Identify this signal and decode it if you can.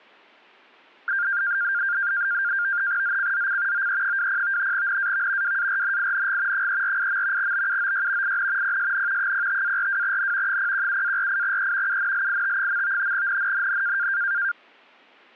NAVTEX (SITOR-B), 100 baud, 170 Hz shift, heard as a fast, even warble, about 1500 Hz centre. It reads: ZCZC OE20 NAV WARNING 348. BUOY IN PSN 05-42N 017-48E UNLIT. NNNN